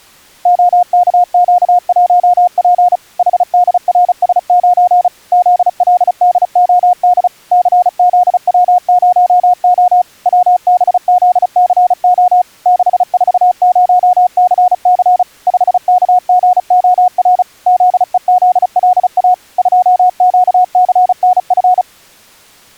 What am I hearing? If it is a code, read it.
Morse code, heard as a keyed tone, machine-sent, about 35 wpm, 720 Hz. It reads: OKQ1P HDRS9 ZLDOD CZW0O WBZCO 640CC 5KGOR ZEZLA 2QCNF